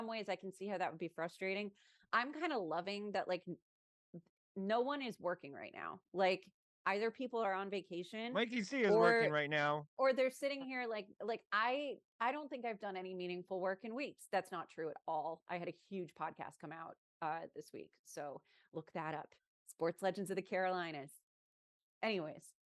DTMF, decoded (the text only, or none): none